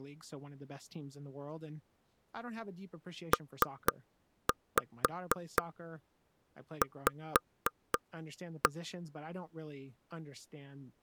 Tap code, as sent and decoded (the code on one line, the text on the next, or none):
3-5 5-1
PV